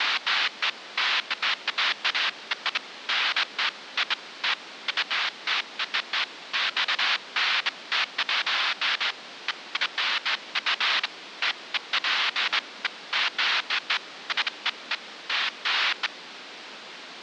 Bursts of noise, with radio static. There is no code.